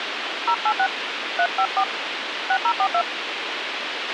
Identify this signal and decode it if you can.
DTMF, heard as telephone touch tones, dialled by hand, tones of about 70 ms, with radio hiss and a squelch burst at the end. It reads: 086 354 6042